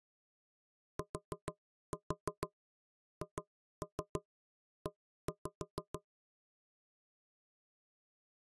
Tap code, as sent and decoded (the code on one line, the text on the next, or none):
4-4 2-3 1-5
THE